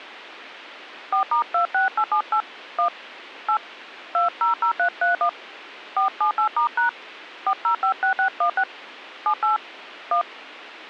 DTMF, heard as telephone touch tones, dialled by hand, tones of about 100 ms, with a squelch burst at the end. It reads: 4*26878 1 8 200331 478*# 4056616 78 1